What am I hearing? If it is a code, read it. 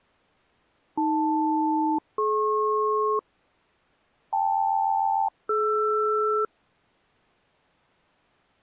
Aircraft SELCAL, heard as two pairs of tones. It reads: AL-DP KL-DR